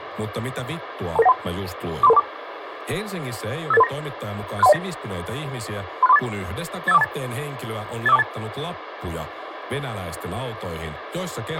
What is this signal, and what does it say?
Five-tone selective call (EIA), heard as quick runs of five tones, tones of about 30 ms, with radio hiss, a squelch burst at the end and speech in Finnish. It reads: 22913 43324 58839 63109 36348 85428 85428